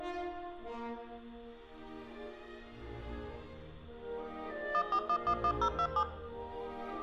DTMF, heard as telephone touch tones, dialled by machine, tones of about 70 ms, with room echo. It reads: 14111027